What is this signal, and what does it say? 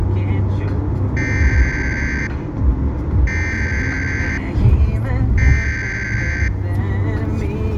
Emergency Alert System (SAME) tones (header bursts), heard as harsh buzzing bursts, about 520.83 baud, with the noise inside a car.